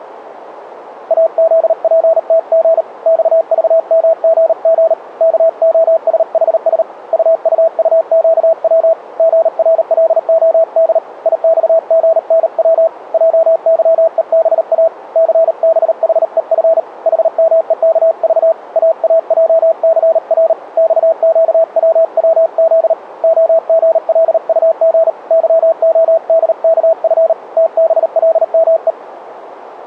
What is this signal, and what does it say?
Morse code, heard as a keyed tone, hand-sent with a paddle, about 38 wpm, 650 Hz, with radio static. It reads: AZPTG XVMGG KOSHS UUUQW GRLOD IXGNW JYEBA CBHEF HMEKV AAJCR XQWWZ OGLUG YODKF TBLME